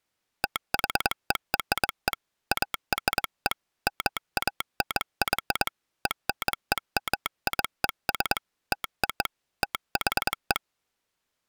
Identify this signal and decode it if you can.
Morse code (American railroad code), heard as a telegraph sounder, hand-sent with a straight key. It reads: THERE ARE MANY ENEMIES TO THE